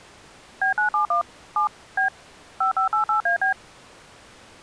DTMF, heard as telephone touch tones, dialled by machine, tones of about 110 ms. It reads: B971 7 B 5588AB